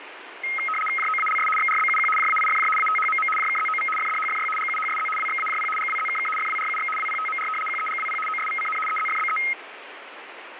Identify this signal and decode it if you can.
RTTY (75 baud, 850 Hz shift), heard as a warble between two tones, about 1700 Hz centre, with radio static. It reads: JOALS XRBUQ JAIFJ ATHMM JKZOV FDHFY GUHSZ WXAJP GWZKK FWRUX WPTMR QEGWP OSVCN EZFBE